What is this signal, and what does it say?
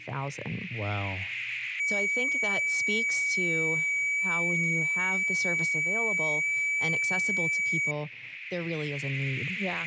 FT8 (one signal), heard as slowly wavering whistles, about 6.25 baud, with radio static and speech in English.